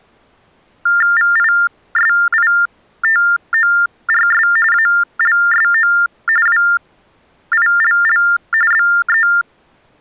TTY/TDD text telephone tones (45.45 baud Baudot), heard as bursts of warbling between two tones, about 400 Hz shift, 1600 Hz centre. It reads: VISITORS ALSO WILL BE